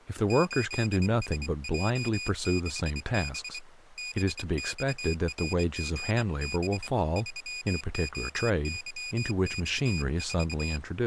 Morse code, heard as a high beeper, hand-sent with a bug key, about 24 wpm, 2450 Hz, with speech in English. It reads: 8SJ6B BXRGB 3OYX4